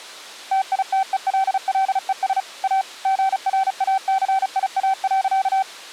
Morse code, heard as a keyed tone, machine-sent, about 35 wpm, 770 Hz. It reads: TITELLES A GRACIA.